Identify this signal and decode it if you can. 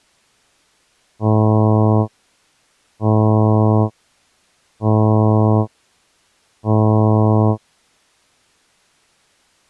Ship horn signal, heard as a ship's horn, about 110 Hz. 4 short. At sea: a pilot vessel's identity signal in fog.